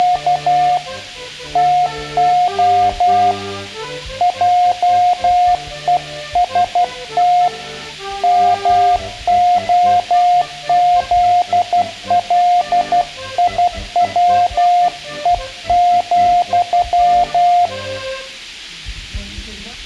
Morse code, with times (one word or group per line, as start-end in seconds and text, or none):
0.0-0.8 …
1.6-3.3 TO
4.2-7.5 JEST
8.2-17.7 MOZLIWE,